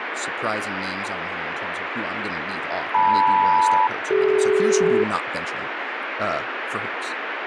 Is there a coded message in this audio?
Yes: aircraft SELCAL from 2.9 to 5.0 s, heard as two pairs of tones, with radio static and speech in English. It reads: LM-CD